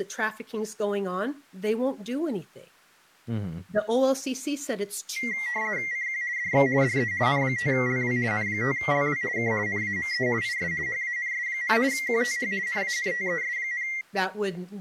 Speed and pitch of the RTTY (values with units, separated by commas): 50 baud, 170 Hz shift, 2000 Hz centre